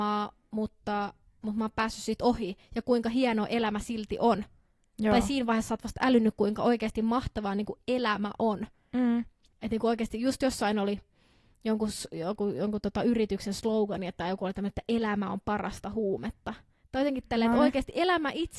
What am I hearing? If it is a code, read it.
Speech in Finnish. There is no code.